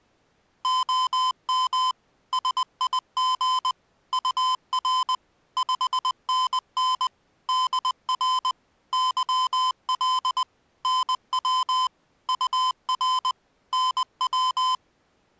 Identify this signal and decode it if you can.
Morse code, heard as electronic beeps, machine-sent, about 20 wpm, 1020 Hz. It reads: OM SIG UR 5NN DR YL NW UR NW